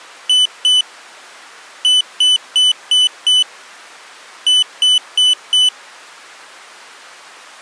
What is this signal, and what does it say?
Beep code, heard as a piezo beeper, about 3000 Hz. 2-5-4.